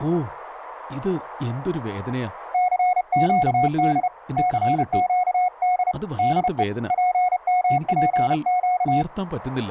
Morse code, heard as a keyed tone, hand-sent with a paddle, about 31 wpm, 730 Hz, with speech in Malayalam. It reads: CQD CQD DE PMPQ